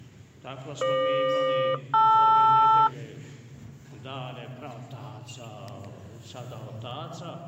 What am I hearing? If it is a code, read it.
Aircraft SELCAL, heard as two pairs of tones. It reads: FQ-LR